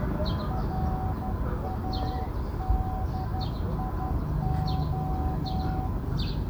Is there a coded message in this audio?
Yes: Morse code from 0.4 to 5.9 s, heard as a keyed tone, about 12 wpm, 750 Hz, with the noise of a park. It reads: RADIO